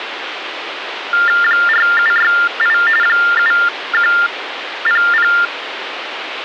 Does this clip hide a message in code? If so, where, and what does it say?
Yes: TTY/TDD text telephone tones (45.45 baud Baudot) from 1.1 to 5.5 s, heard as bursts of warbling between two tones, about 400 Hz shift, 1600 Hz centre, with phone line noise. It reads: 4768 7100